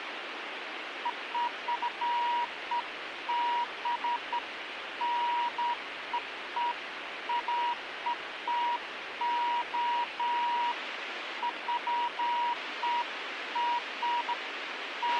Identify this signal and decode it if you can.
Beeps of irregular length, with radio hiss and a squelch burst at the end. There is no code.